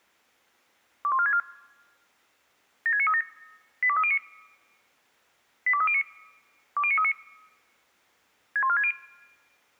Five-tone selective call (ZVEI), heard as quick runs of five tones, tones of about 70 ms. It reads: 21464 76937 82309 82309 20939 61460